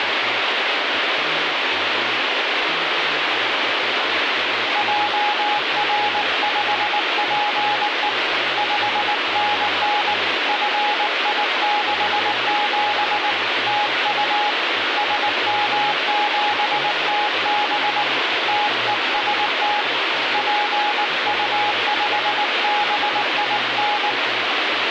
Morse code, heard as a keyed tone, hand-sent with a paddle, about 19 wpm, 830 Hz, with radio static. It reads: JR5PE 5NN FI67 TU SM7TB TEST PU5BIN